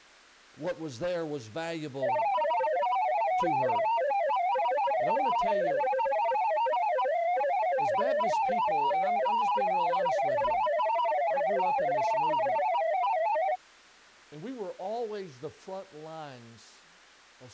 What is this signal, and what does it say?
Multi-tone FSK (Olivia or MFSK type), about 500 Hz wide, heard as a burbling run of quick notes, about 31.25 baud, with speech in English.